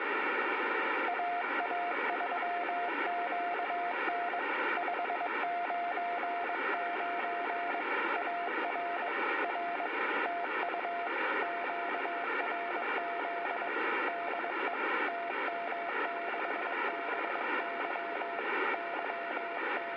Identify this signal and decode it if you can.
Morse code, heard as a keyed tone, hand-sent with a bug key, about 22 wpm, 690 Hz, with radio static and room echo. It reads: AA3QN 599 AR R TU QRZ DE TM6BY …